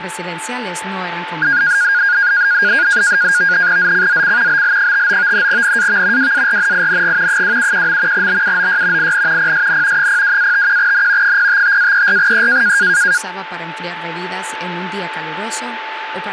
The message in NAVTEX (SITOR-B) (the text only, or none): ZCZC BL59 NAV WARNING 271. BUOY IN PSN 02-51N 055-34E